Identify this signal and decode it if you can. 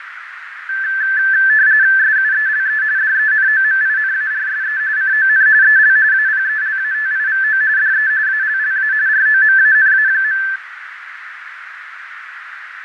RTTY (45.45 baud, 170 Hz shift), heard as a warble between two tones, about 1650 Hz centre, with radio static, fading and a narrow filter. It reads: SUELE DENOMINARSE CON EL APELATIVO DE ALLA ROMANA.